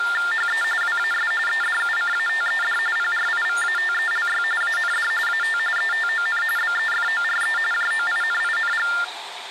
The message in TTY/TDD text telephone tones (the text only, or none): HE WAS EDUCATED PRIVATELY AND AT ETON BEFORE JOINING